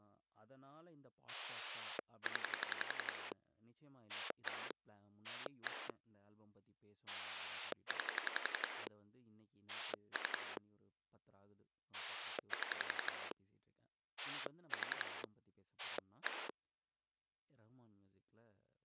Pulse dialling, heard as a rotary dial, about 11 pulses a second, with speech in Tamil. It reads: 0 1 1 9 3 7 4 1